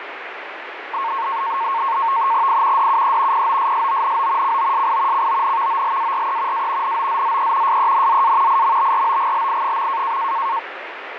NAVTEX (SITOR-B), 100 baud, 170 Hz shift, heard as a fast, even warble, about 1000 Hz centre, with radio static. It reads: I DUE POSSONO COSI CONVOLARE A NOZZE SENZA IMBROGLI.